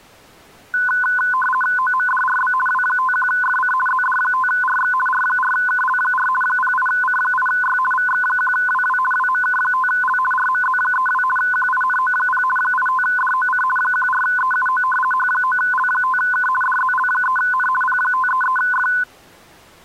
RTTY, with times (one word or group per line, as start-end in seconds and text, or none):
1.8-2.5 OMDRB
2.7-3.7 W51FC
3.9-4.9 ZD5RX
5.1-6.3 R4KL4
6.4-7.8 08C8Y
7.9-9.0 VX1WW
9.1-10.2 WMK5L
10.3-11.2 RMZ32
11.4-12.4 QINO0
12.6-13.6 85DOC
13.8-14.8 14EUO
15.1-16.5 H9L5K
16.6-17.7 DZL3N
17.8-18.9 P533F